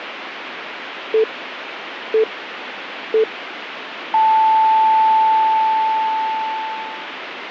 Radio time signal (three low pips and a long one an octave up, as on NHK), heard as pips, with radio static.